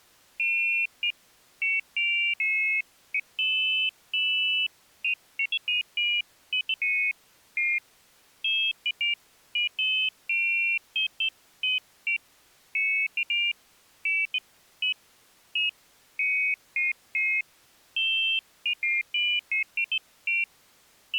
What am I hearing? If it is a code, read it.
Pairs of high tones at irregular times. There is no code.